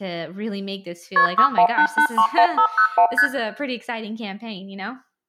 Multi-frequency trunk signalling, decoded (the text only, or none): KP 618831501 ST